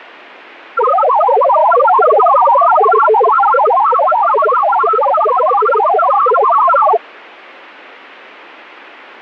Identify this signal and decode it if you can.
Multi-tone FSK (Olivia or MFSK type), about 1000 Hz wide, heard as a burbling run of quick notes, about 62.5 baud, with radio static.